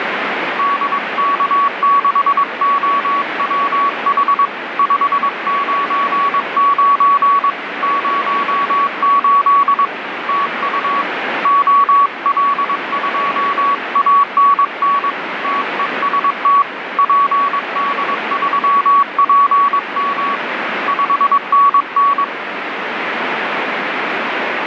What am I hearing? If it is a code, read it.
Morse code, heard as a keyed tone, hand-sent with a paddle, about 22 wpm, 1130 Hz, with radio static. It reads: DK6OWH 599 08 TU OL2ANN TEST PD3PM 5NN